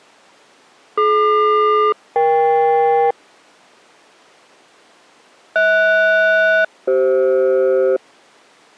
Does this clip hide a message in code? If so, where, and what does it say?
Yes: aircraft SELCAL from 1.0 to 8.0 s, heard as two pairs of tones. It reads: DQ-EK HS-CF